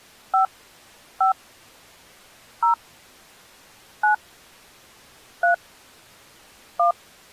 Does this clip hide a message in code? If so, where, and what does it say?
Yes: DTMF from 0.3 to 6.9 s, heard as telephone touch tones, dialled by hand, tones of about 120 ms. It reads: 5 5 0 9 3 1